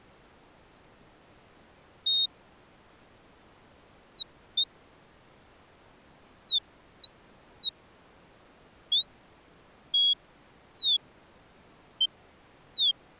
Bird-like chirps. There is no code.